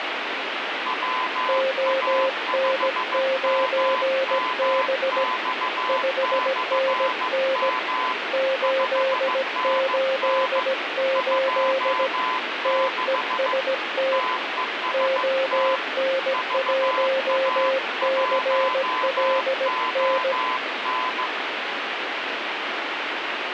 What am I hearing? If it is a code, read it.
Morse code, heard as two keyed tones, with radio static. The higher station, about 15 wpm, 1020 Hz: WA5MMX/M 5NN 26 TEST VA1ON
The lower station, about 17 wpm, 530 Hz: ON9B 5NN 888 TEST ON1CLN